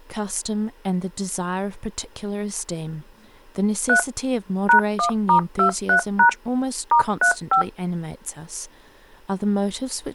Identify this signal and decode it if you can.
DTMF, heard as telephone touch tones, dialled by machine, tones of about 100 ms, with speech in English. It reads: 3 #1*23# *35